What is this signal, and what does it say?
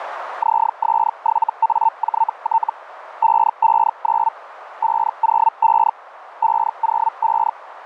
Hellschreiber (Feld-Hell, 122.5 baud), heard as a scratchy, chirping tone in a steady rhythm, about 900 Hz, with radio static. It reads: ZS7AJT 559 505 505